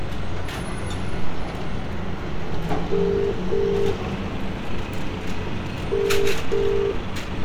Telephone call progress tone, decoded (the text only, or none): ringback tone